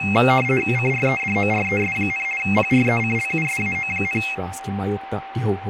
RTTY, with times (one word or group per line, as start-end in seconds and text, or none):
0.8-2.2 CREDORES,
2.4-4.2 PRECLUSAO,